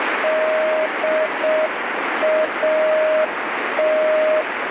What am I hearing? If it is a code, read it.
Morse code, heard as a keyed tone, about 6 wpm, 620 Hz, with radio static. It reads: DAT